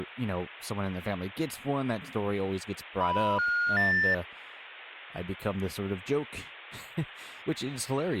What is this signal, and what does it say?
Telephone call progress tone (North American plan), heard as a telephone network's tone, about 980, 1430, 1800 Hz, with speech in English. Special information tone.